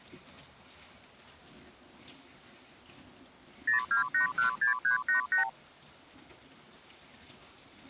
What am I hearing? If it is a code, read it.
Multi-frequency trunk signalling (R2, with the far end's replies), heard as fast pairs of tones, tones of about 120 ms, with kitchen noise. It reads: 02816388